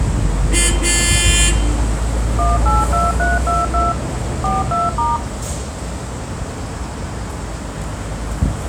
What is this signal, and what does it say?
DTMF, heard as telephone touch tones, dialled by machine, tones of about 180 ms, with street noise. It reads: 182322 42*